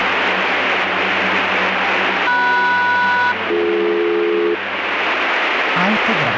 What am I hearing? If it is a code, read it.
Aircraft SELCAL, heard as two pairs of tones, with radio static. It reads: MS-BD